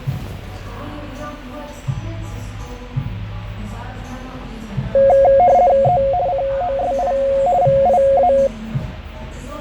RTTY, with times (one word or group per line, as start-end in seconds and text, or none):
5.8-6.0 E
6.3-7.1 COSI
7.6-8.3 VIA